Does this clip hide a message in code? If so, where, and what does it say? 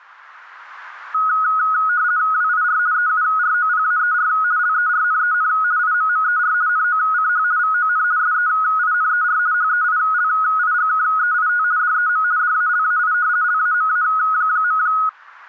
Yes: RTTY (50 baud, 170 Hz shift) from 1.1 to 15.1 s, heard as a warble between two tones, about 1360 Hz centre. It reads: WIR EUROPAER LERNEN IMMER NOCH VON SEINER HEILIGKEIT DEM DALAI LAMA.